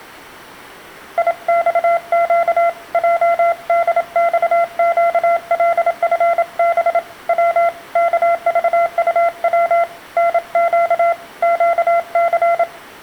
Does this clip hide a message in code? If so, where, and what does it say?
Yes: Morse code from 1.1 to 12.7 s, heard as a keyed tone, hand-sent with a paddle, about 27 wpm, 680 Hz, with room echo. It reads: IXQ JDXQLFB W KVUW NQ QC